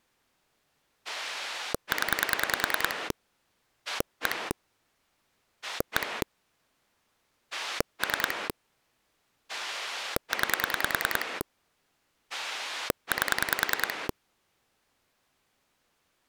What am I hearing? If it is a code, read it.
Pulse dialling, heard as a rotary dial, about 10 pulses a second. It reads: 0 1 1 3 9 8